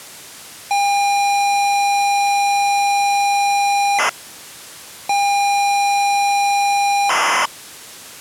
ZX Spectrum tape loading, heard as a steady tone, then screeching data.